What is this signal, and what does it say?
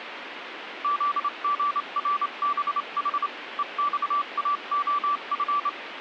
Morse code, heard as a keyed tone, hand-sent with a straight key, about 27 wpm, 1160 Hz, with radio static. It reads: ZGRBH EXAOF